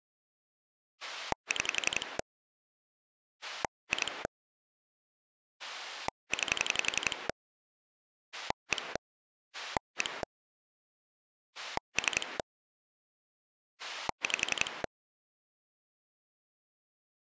Pulse dialling, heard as a rotary dial, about 11 pulses a second. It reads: 6 2 9 1 1 3 5